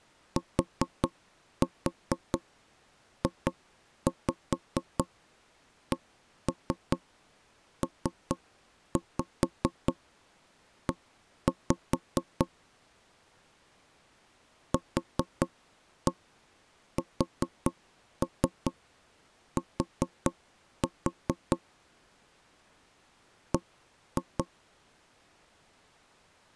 Tap code, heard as knocks on wood, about 4 knocks a second. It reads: TJCPE QST B